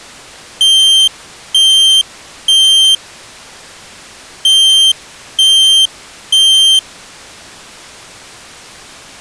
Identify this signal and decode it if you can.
Alarm pattern, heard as an alarm's beeps, played twice, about 3150 Hz. Temporal three. Smoke or fire, evacuate.